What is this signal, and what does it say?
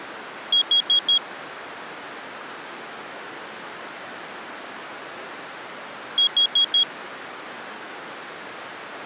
Alarm pattern, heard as an alarm's beeps, played twice, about 3300 Hz. Temporal four. Carbon monoxide.